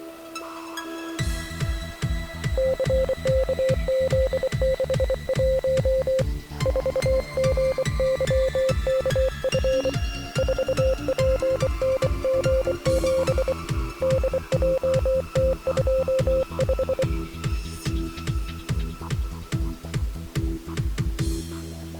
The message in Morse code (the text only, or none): CKZ61 4GYKF 4PNG7 DJT25